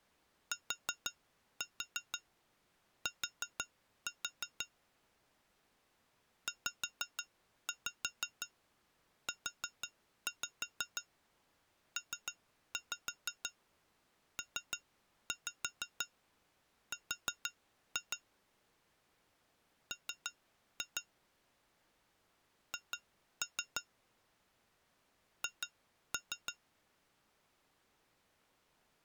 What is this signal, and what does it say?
Tap code, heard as taps on glass, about 6 knocks a second. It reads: TT ZUPPR M H H